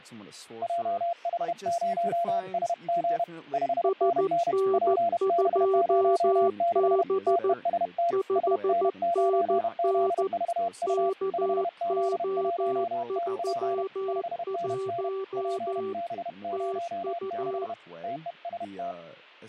Morse code, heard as two keyed tones, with fading and speech in English. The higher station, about 31 wpm, 690 Hz: JH0SG 5NN PB06 TEST SN9ZVU 5Z1TP 5NN PB06 TEST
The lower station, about 14 wpm, 390 Hz: SN2B 5NN KO31 TU